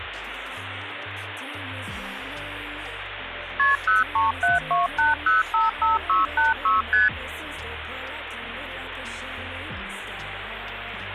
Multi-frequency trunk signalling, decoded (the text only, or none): KP 03728055686 ST